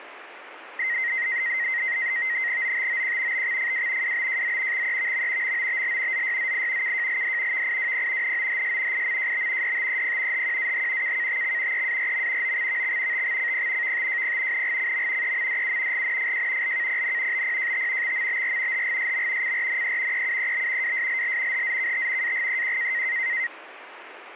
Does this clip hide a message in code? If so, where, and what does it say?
Yes: NAVTEX (SITOR-B), 100 baud, 170 Hz shift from 0.8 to 23.5 s, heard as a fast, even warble, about 2000 Hz centre, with radio static. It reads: OTOQ BXFW WBJZ XEVM MOBL ZYZI KJLD VIWP NOHS IMJB DTEP HQAH KKTX EARM OXVX TXCP VTJP NGCM EMDU GNFJ LKPN BPJT XMBR HGSM CRNE EUEB WSLL HZKT AGEQ